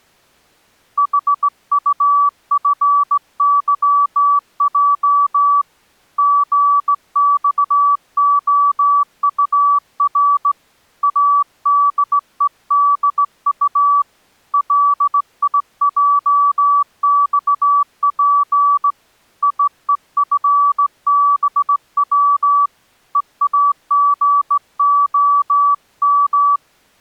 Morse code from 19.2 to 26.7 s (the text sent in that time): IEFBW EAGOM